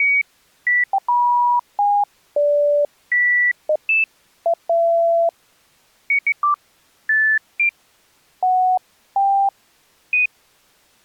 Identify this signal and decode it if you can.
Electronic bleeps of random pitch and length. There is no code.